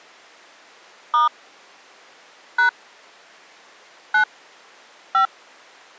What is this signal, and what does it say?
DTMF, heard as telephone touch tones, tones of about 120 ms. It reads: * # 9 5